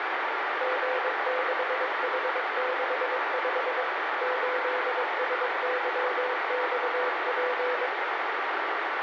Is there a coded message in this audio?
Yes: Morse code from 0.5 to 7.9 s, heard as a keyed tone, machine-sent, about 22 wpm, 500 Hz, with heavy radio static. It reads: G6H65 8SYXP